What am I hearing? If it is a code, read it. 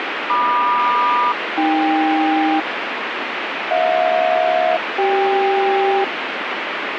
Aircraft SELCAL, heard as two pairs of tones, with radio static. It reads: MQ-AK HJ-CK